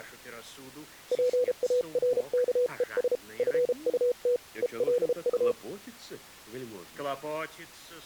Morse code, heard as a keyed tone, hand-sent with a paddle, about 33 wpm, 490 Hz, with speech in Russian. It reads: PARKES FUT ELU